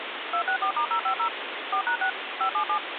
DTMF, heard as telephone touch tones, dialled by machine, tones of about 90 ms, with phone line noise. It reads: 264*050 4#6 577